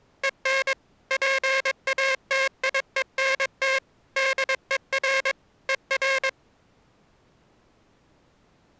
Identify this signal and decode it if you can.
Morse code, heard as a buzzer, machine-sent, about 22 wpm. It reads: EN PATIENT DER ER